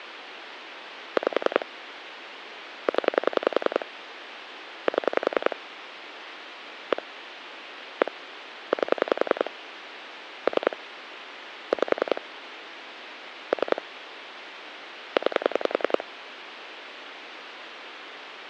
Pulse dialling, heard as clicks on a phone line, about 10 pulses a second, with phone line noise. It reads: 5 0 7 1 1 8 3 5 3 9